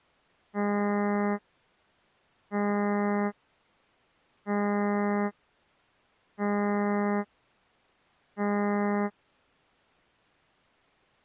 Ship horn signal, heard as a ship's horn, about 200 Hz. 5 short. At sea: I doubt that you are doing enough to avoid a collision.